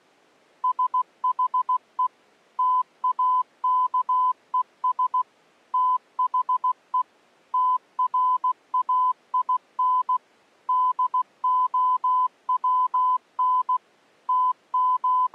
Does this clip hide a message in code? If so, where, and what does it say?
Yes: Morse code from 0.6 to 15.3 s, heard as a keyed tone, machine-sent, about 16 wpm, 1010 Hz. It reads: SHE TAKES THE TRAIN DOWN …